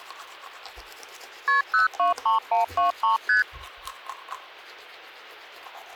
Multi-frequency trunk signalling (R1, as on North American trunks), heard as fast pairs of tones, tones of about 130 ms, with hum and the noise of a restroom. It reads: KP 023123 ST